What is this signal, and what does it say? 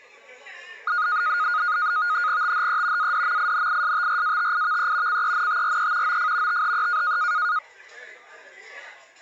NAVTEX (SITOR-B), 100 baud, 170 Hz shift, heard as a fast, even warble, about 1340 Hz centre, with the noise of a crowd indoors. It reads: THE ADMINISTRATIVE CENTRE OF THE